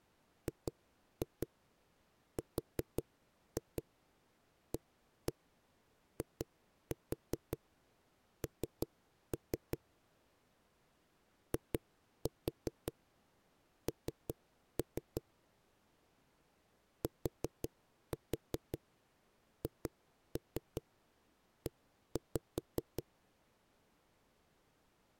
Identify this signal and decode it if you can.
Tap code, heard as knocks on a wall, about 5 knocks a second. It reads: GRAIN IN THE